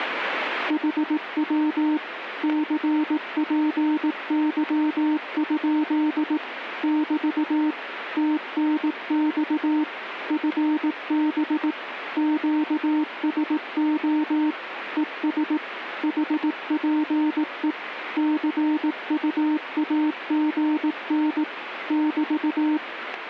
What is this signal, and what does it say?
Morse code, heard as a keyed tone, machine-sent, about 18 wpm, 300 Hz, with radio static. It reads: HW CPY? <BT> TNX FB QSO ES HPE CUAGN <BT>